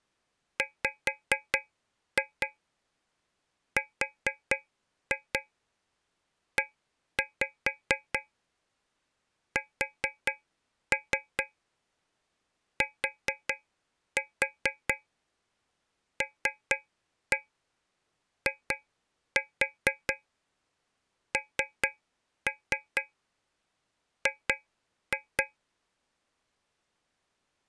Tap code, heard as taps on a metal pipe, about 4 knocks a second. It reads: WRESTLING